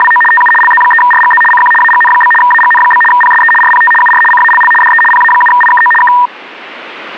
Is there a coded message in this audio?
Yes: RTTY (75 baud, 850 Hz shift) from 0.0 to 6.3 s, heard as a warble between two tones, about 1400 Hz centre. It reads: … TU LZ3RGZ CQ AGN? AGN? PSE RPT UR CALL DE PA7IKO K